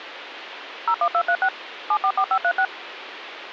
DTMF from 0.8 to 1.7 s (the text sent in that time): 01236